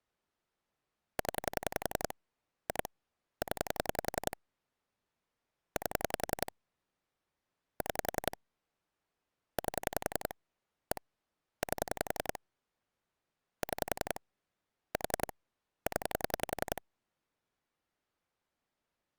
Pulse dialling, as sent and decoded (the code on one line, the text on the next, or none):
10 / 2 / 10 / 8 / 6 / 8 / 1 / 8 / 6 / 4 / 10
0 2 0 8 6 8 1 8 6 4 0